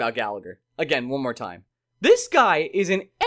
Speech in English. There is no code.